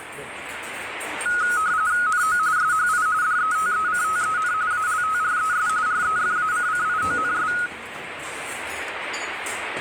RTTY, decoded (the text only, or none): NO SHI DETECTEN ALTRES REFACCIONS